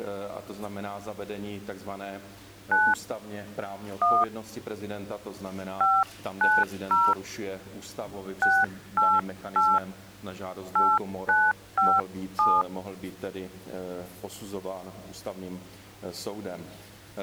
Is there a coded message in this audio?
Yes: DTMF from 2.7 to 12.6 s, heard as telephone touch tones, dialled by hand, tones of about 220 ms. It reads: 9 1 590 688 8957